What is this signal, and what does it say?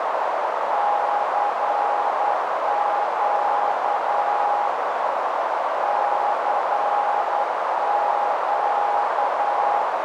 Morse code, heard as a keyed tone, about 10 wpm, 820 Hz, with heavy radio static and a narrow filter. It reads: CQ CQ